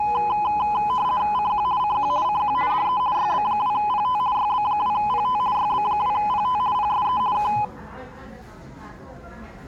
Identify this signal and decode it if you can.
RTTY (50 baud, 170 Hz shift), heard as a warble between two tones, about 920 Hz centre, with the noise of a crowd indoors. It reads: CQ CQ CQ DE YB2PT YB2PT YB2PT PSE K